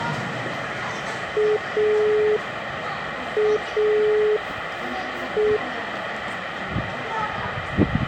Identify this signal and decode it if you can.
Telephone call progress tone (pulsed, as in Italy), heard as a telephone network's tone, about 420 Hz, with phone line noise and the noise of a park. Dial tone.